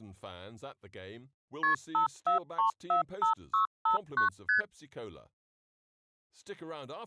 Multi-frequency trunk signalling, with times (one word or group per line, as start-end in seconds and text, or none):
1.6-1.7 KP
1.9-4.3 54345659
4.5-4.6 ST